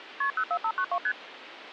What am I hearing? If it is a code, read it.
Multi-frequency trunk signalling (R1, as on North American trunks), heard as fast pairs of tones, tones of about 70 ms, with phone line noise. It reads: KP 04592 ST